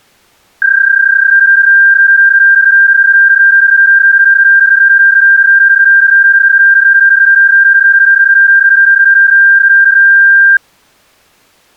PSK31 (31.25 baud), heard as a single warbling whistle, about 1600 Hz.